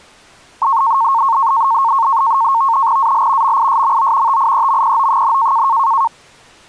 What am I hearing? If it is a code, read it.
NAVTEX (SITOR-B), 100 baud, 170 Hz shift, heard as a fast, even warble, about 1000 Hz centre. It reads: AL MISMO TIEMPO,